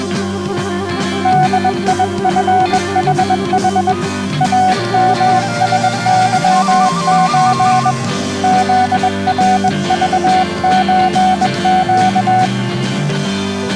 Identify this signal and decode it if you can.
Morse code (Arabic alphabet), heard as a keyed tone, hand-sent with a bug key, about 21 wpm, 740 Hz. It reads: ديفحح امسظز ذرضزق